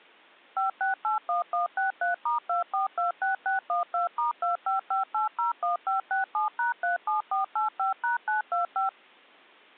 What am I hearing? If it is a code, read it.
DTMF, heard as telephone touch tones, dialled by machine, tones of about 130 ms. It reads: 5681163*2426612*255801567#37485#925